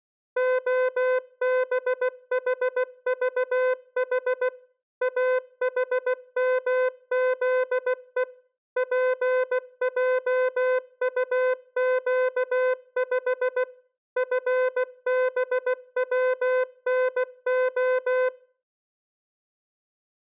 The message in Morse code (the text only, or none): OBHVH AHMZE PJUQ5 FBWNO